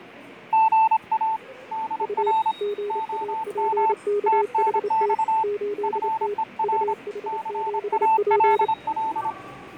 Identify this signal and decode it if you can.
Morse code, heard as two keyed tones, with fading and the noise of a subway station. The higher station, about 26 wpm, 880 Hz: GA DR OM TNX FER CALL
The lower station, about 28 wpm, 410 Hz: U GAPKHT 8T UH7P